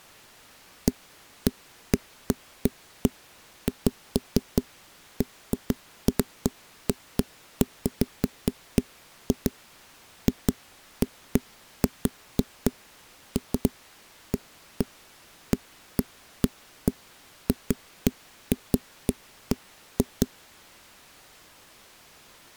Irregular knocks on a wall. There is no code.